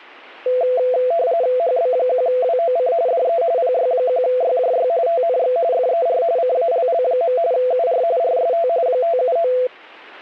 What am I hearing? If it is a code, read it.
RTTY (45.45 baud, 170 Hz shift), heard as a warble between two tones, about 590 Hz centre. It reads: HB1WOC DE PY1YJY TNX FER CALL. UR RST 579